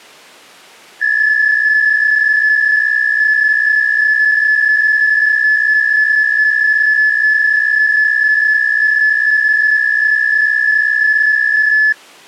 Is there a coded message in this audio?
Yes: PSK63 (62.5 baud) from 1.0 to 11.9 s, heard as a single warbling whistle, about 1700 Hz.